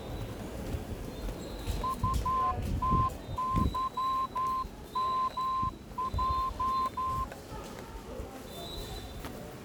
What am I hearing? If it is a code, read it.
Morse code, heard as a whistle, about 12 wpm, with the noise of a subway station. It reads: UTYMJ